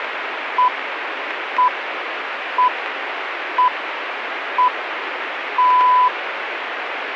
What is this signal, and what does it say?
Radio time signal (six pips, as the Greenwich Time Signal), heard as pips, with radio static.